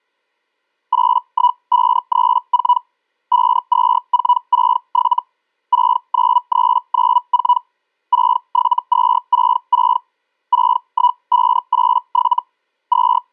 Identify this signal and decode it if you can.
Hellschreiber (Feld-Hell, 122.5 baud), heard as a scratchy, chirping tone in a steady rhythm, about 980 Hz. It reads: 81534 52467 69394 67266 61587 …